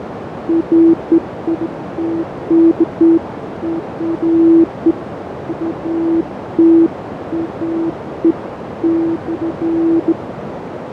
Beeps of irregular length, with radio static, fading and a narrow filter. There is no code.